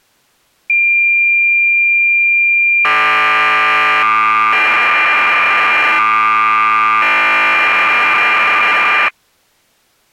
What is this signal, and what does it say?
Cassette data (Kansas City type), 1200 baud, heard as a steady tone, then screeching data.